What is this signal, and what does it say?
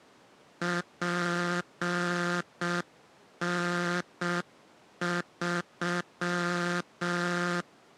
Morse code, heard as a buzzer, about 6 wpm. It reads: PN3